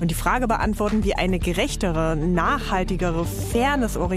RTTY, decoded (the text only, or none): none